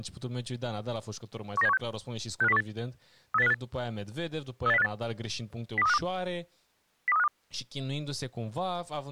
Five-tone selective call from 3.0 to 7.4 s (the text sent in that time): 38058 38058 02352 02352